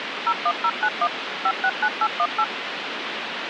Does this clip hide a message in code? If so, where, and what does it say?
Yes: DTMF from 0.3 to 2.4 s, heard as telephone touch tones, dialled by machine, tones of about 60 ms, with phone line noise. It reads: 01091 569818